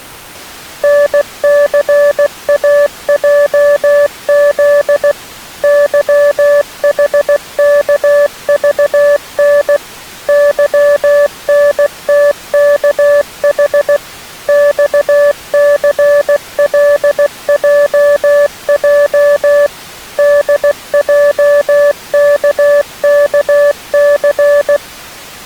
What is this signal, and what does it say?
Morse code, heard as a keyed tone, machine-sent, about 16 wpm, 580 Hz. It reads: NCAJZ YHKVN YNTKH XCLJJ DJKKC